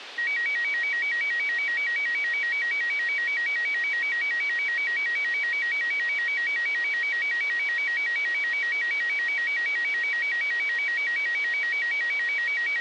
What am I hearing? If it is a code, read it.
A tone that alternates evenly between two pitches, with radio hiss. There is no code.